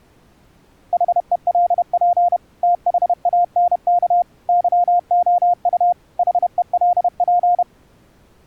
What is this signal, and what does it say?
Morse code, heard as a keyed tone, machine-sent, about 31 wpm, 700 Hz. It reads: HELP THANK YOU HELP